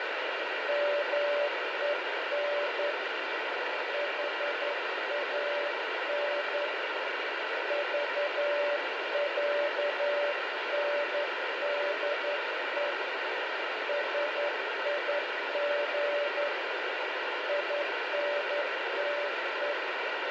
Morse code (with Swedish letters), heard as a keyed tone, hand-sent with a straight key, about 11 wpm, 580 Hz, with heavy radio static. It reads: MEN HAN VÄNDE SIG INTE